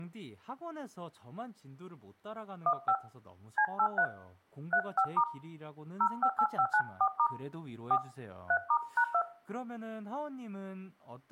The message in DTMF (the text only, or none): 15 C83 35* 058594* 4 3*#2